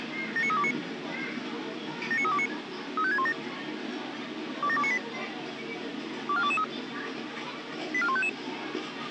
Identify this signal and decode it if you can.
Five-tone selective call (ZVEI), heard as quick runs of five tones, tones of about 70 ms, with radio hiss, a squelch burst at the end and the noise of a park. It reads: 79329 79329 35617 27298 24223 84155